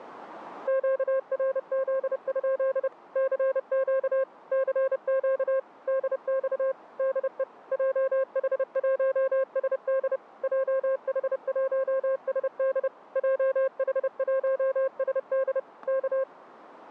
Morse code, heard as a keyed tone, machine-sent, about 30 wpm, 530 Hz, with static crashes. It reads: QRZ? CQ CQ DX DE JH1SD JH1SD JH1SD K